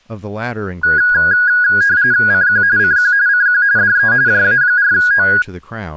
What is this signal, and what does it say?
RTTY (45.45 baud, 170 Hz shift), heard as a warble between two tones, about 1550 Hz centre, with speech in English. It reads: CQ CQ CQ DE JA4O